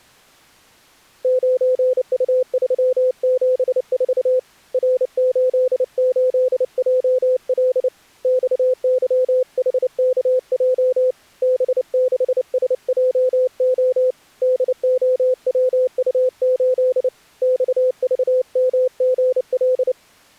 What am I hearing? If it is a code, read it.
Morse code, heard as a keyed tone, hand-sent with a paddle, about 29 wpm, 510 Hz. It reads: 9U374 R88JL XYHKJ B6SJO DOWU8 XVMGL